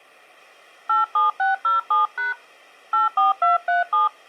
DTMF, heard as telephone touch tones, dialled by hand, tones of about 150 ms. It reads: 87607# 84237